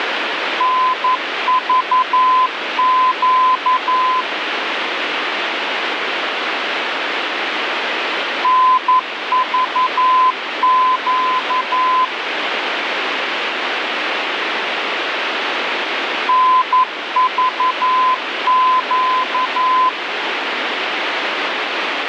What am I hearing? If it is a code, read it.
Morse code, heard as a keyed tone, machine-sent, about 11 wpm, 1020 Hz, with radio static. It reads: NVQ NVQ NVQ